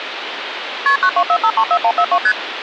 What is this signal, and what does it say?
Multi-frequency trunk signalling (R1, as on North American trunks), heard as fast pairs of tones, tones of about 70 ms, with phone line noise. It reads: KP 924534142 ST